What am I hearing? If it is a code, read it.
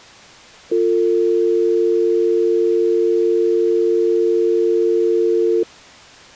Telephone call progress tone (North American or UK plan), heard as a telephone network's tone, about 350, 450 Hz. Dial tone.